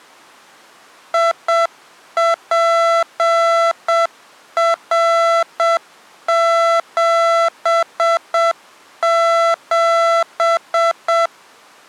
Morse code, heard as electronic beeps, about 7 wpm, 670 Hz. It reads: IPR77